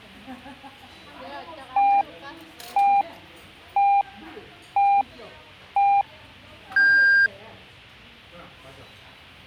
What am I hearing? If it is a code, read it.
Radio time signal (five pips and a higher one, as on Chinese radio), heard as pips, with the noise of a restaurant.